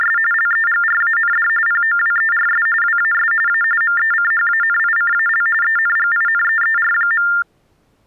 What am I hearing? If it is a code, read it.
TTY/TDD text telephone tones (45.45 baud Baudot), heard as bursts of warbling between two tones, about 400 Hz shift, 1600 Hz centre. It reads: … LEGRAND POWERS WAS A MECHANICAL ENGINEER.